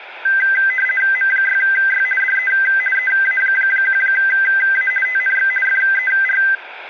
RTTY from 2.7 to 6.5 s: EA1A TNX FER

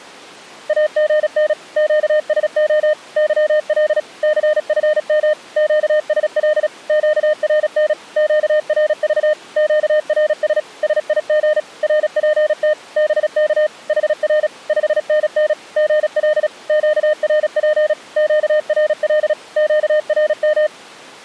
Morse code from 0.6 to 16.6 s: AGN QSO YL CFM QSL QRN QRV QRS SIG RPT BK HR 5NN GL

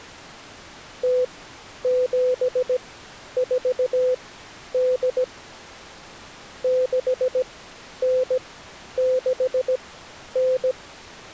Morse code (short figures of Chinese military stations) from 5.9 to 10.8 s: 6969

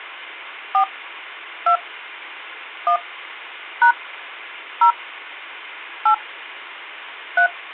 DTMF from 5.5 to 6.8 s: 8

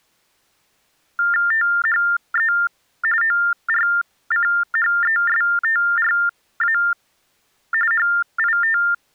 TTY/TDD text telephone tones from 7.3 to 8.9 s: HIT

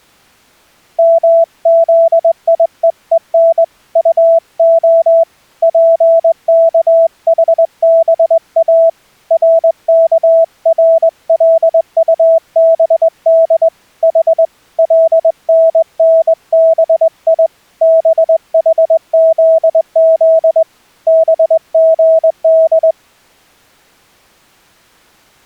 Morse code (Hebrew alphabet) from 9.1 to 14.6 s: רכרלטבד ח

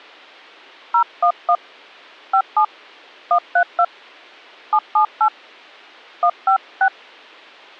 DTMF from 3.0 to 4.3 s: 132

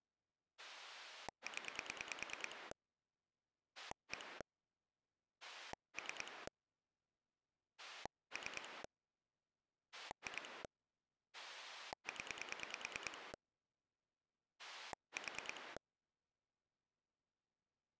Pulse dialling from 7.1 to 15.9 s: 3 2 0 4

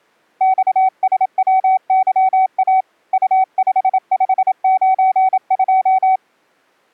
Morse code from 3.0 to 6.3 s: U5592

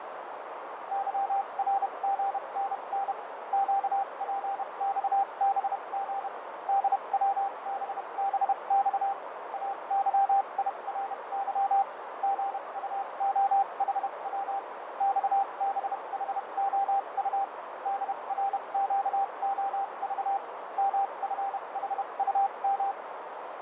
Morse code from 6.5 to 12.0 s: DWBBX AYIRY

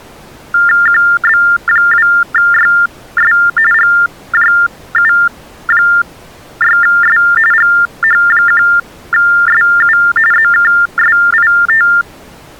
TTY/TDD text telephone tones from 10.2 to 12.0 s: ZKSIT

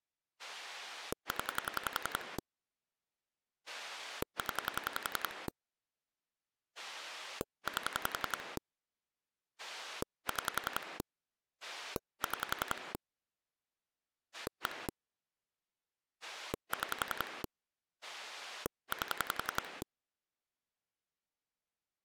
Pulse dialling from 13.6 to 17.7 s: 1 6

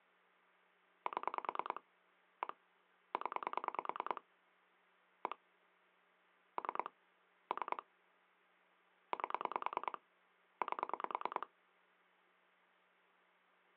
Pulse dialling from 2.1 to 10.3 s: 1 0 1 3 3 8

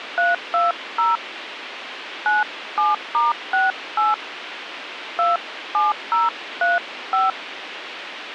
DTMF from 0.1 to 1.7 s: 320

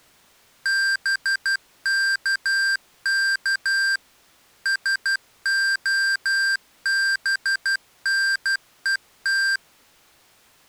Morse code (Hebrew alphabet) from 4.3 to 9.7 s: שהבנות

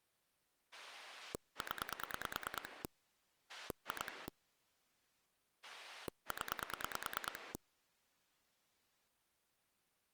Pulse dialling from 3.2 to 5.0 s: 2

